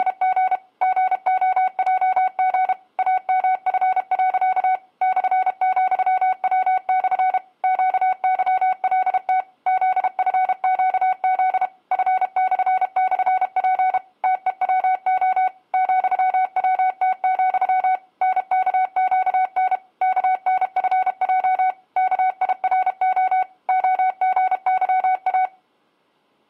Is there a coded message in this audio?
Yes: Morse code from 0.0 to 25.5 s, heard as a keyed tone, machine-sent, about 32 wpm, 750 Hz. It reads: … GOJG AMF. /,W/ QYLT ZFQZ F//P TEWO ,WT, NKQN KNFJ KIRO OGYA